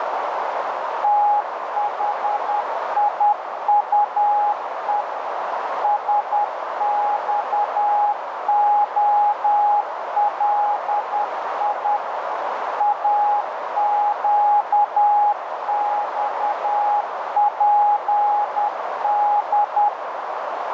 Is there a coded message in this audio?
Yes: Morse code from 1.0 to 19.9 s, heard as a keyed tone, machine-sent, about 10 wpm, 830 Hz, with heavy radio static and a narrow filter. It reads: THIUE SXOLI AQXPD